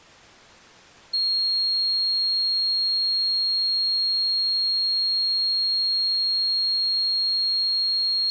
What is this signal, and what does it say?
A steady tone. There is no code.